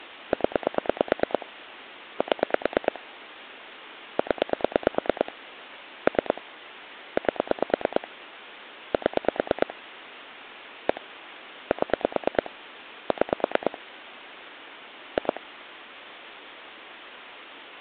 Pulse dialling, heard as clicks on a phone line, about 9 pulses a second. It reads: 0 7 0 3 8 7 1 7 6 2